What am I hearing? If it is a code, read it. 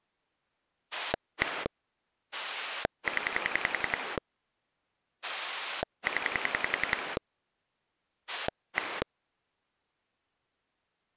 Pulse dialling, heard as a rotary dial, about 10 pulses a second. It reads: 1 0 0 1